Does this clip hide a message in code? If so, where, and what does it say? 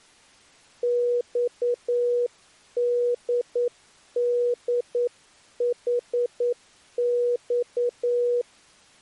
Yes: Morse code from 0.8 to 8.5 s, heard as a keyed tone, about 9 wpm, 480 Hz. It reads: XDDHX